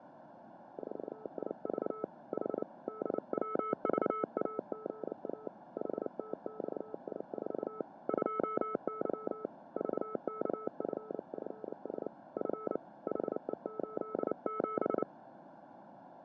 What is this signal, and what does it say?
Morse code, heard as a keyed tone, hand-sent with a paddle, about 29 wpm, 430 Hz, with fading. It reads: 4IV H DWVAGA HTXI4 2Y VKFFS F HE87